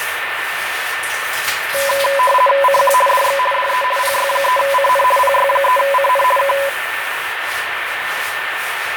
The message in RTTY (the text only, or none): CQ DX DE PY3CN PY3CN K